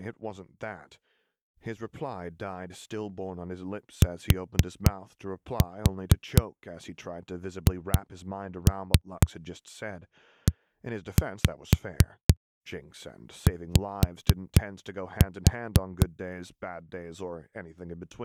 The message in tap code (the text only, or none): THEY